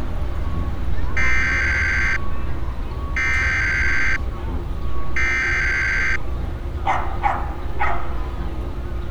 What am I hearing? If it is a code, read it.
Emergency Alert System (SAME) tones (header bursts), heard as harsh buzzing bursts, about 520.83 baud, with street noise.